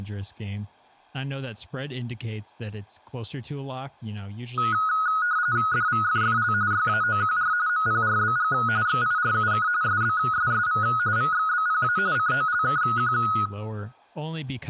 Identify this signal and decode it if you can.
RTTY (45.45 baud, 170 Hz shift), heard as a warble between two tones, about 1360 Hz centre, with room echo and speech in English. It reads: DVFFL YAOQR MPRBG XIRUK SBSSV VXBPA COLKQ